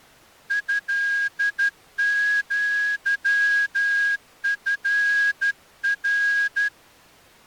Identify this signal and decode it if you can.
Morse code (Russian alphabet), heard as a whistle, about 12 wpm. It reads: ЭЪФР